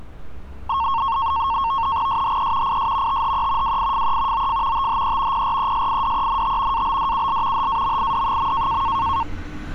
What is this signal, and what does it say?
NAVTEX (SITOR-B), 100 baud, 170 Hz shift, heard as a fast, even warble, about 1000 Hz centre, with street noise. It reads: SHE IS THE WIFE OF THE PRESIDENT ABDUL HAMID.